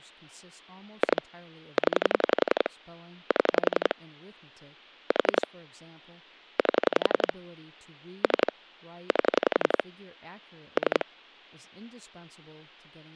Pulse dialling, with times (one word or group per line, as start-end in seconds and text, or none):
1.0-1.2 2
1.8-2.7 0
3.3-3.9 7
5.1-5.5 4
6.6-7.3 8
8.2-8.5 3
9.1-9.8 8
10.8-11.0 3